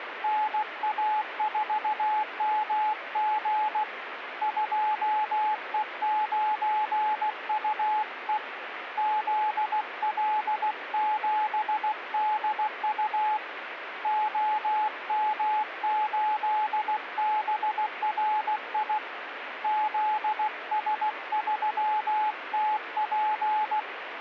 Morse code, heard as a keyed tone, hand-sent with a paddle, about 16 wpm, 860 Hz, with radio static. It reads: NA4MG 2E9UE ZL7DU OM8BRI ZS3TP